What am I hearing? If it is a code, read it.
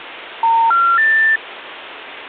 Telephone call progress tone (North American plan), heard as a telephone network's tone, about 910, 1370, 1800 Hz, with phone line noise. Special information tone.